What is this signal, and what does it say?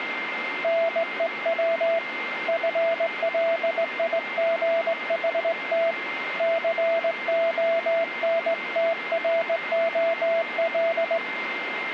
Morse code, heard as a keyed tone, hand-sent with a straight key, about 19 wpm, 660 Hz, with radio static and a steady whistle near 2100 Hz. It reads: NEW FLIGHT CONTROL